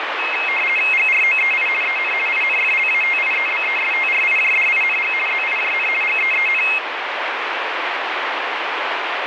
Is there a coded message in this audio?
Yes: RTTY (50 baud, 450 Hz shift) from 0.2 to 6.8 s, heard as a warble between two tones, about 2350 Hz centre, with radio static. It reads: GROEI EN INFLATIEBESTRIJDING ZIJN GEEN